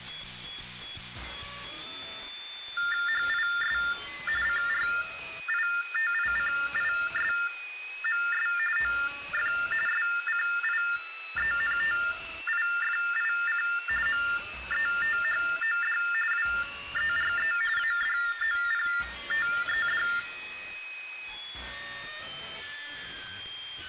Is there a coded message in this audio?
Yes: TTY/TDD text telephone tones (45.45 baud Baudot) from 2.8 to 20.2 s, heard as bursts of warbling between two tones, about 400 Hz shift, 1600 Hz centre, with room echo. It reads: HIS CRITICISMS OF SCIENTIFIC METHOD WERE ADOPTED